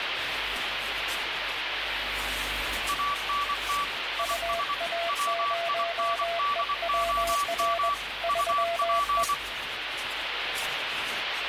Morse code, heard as two keyed tones, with radio static. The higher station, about 24 wpm, 1150 Hz: ANT IS WINDOM UP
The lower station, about 21 wpm, 680 Hz: UA0EWR 3E